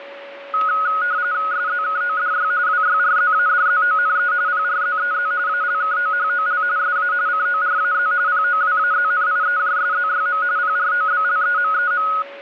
RTTY (45.45 baud, 170 Hz shift), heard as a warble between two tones, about 1360 Hz centre, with a steady whistle near 560 Hz. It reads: SZKODY WYRZADZONE PRZEZ ALKOHOL SA CORAZ POWAZNIEJSZYM PROBLEMEM